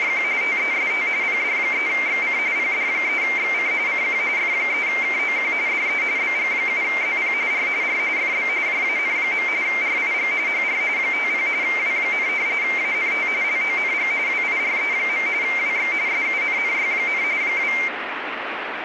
RTTY (45.45 baud, 170 Hz shift), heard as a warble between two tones, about 2200 Hz centre, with radio static. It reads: … TEST PD3XC PD3XC CQ F3KOQ DE BG7ZP R R FB JAN. RIG HR 50 W, ANT LONG WIRE. WX SUNNY, 2